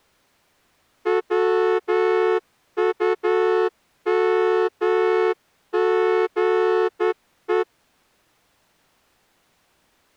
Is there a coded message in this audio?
Yes: Morse code (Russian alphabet) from 1.0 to 7.7 s, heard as a horn, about 10 wpm. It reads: ВУМГЕ